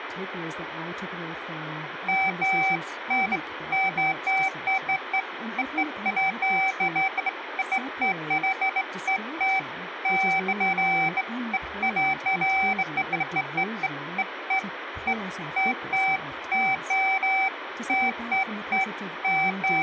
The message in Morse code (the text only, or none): none